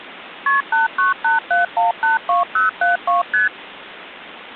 Multi-frequency trunk signalling (R1, as on North American trunks), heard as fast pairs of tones, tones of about 140 ms, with phone line noise. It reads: KP 8987182072 ST